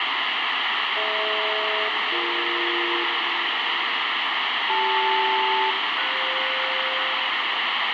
Aircraft SELCAL, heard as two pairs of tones, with heavy radio static. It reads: DH-BE CL-FS